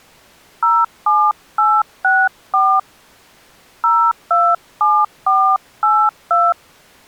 DTMF, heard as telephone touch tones, dialled by hand, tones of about 230 ms. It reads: 07864 027482